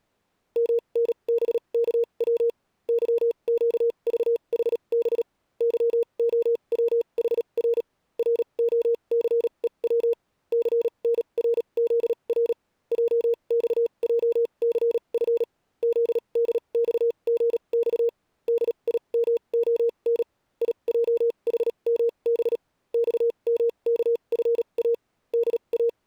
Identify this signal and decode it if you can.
Morse code, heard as a keyed tone, machine-sent, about 37 wpm, spaced as for 29 wpm, 470 Hz. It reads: MNBKW YQVHB YOWHR ROCEW CNRZR JXJCF ZDXGX DIMON IJHMB XMKFA …